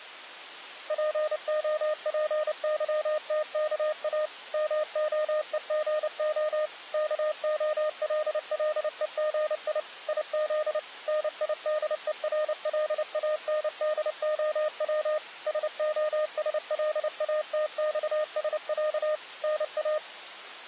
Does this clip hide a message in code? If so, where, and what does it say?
Yes: Morse code (Russian alphabet) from 0.8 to 20.0 s, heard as a keyed tone, machine-sent, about 29 wpm, 610 Hz. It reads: ПОПЫТКА МОЕГО КОЛЛЕГИ ИЗ НИДЕРЛАНДОВ СОСЛАТЬСЯ НА